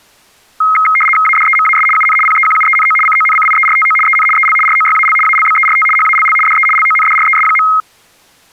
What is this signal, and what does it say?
RTTY (75 baud, 850 Hz shift), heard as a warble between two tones, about 1700 Hz centre. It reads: ADEMAS UN PEQUENO CONCIERTO EN EL ROYAL ALBERT HALL DE LONDRES.